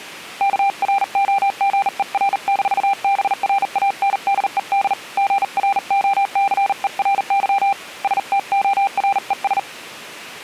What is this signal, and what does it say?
Morse code, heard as a keyed tone, hand-sent with a bug key, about 39 wpm, 790 Hz. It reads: KROGER-BRANDED GROCERY STORES